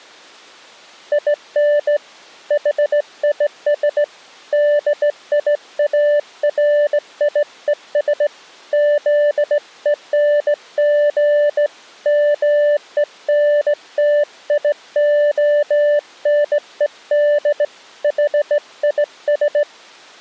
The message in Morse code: IN HIS DIARIES ZENG MENTIONED HIS

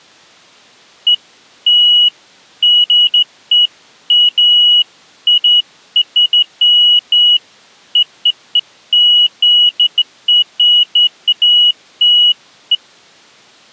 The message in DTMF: none

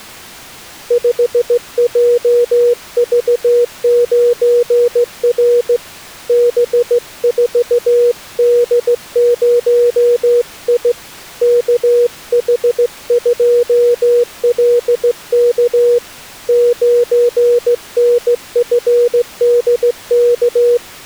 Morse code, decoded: 5JV9R B4D0I KH2LK 9NFDK

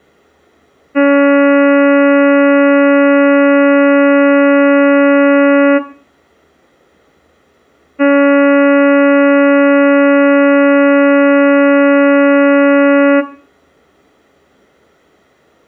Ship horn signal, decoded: 2 long

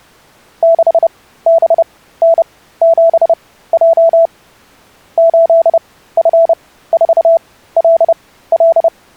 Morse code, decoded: 6BN7J 8F4LL

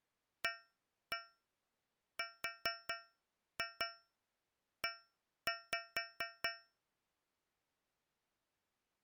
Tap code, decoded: ARE

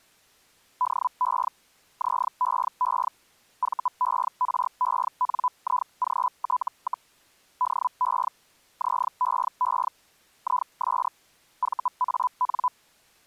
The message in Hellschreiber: DE ZEE VERENIGT, DE ZEE IS VAN

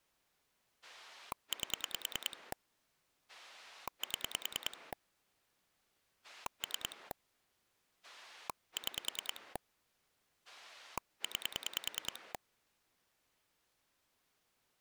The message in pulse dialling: 8 7 3 6 9

